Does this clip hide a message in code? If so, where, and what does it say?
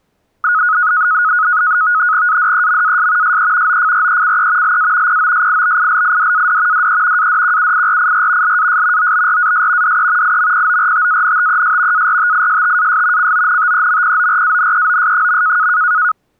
Yes: NAVTEX (SITOR-B), 100 baud, 170 Hz shift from 0.4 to 16.1 s, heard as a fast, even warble, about 1360 Hz centre. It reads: ADEMAS SE OFRECE LA POSIBILIDAD DE ADQUIRIR LAS OBRAS DE IMPORTANTES ARTISTAS CONTEMPORANEOS.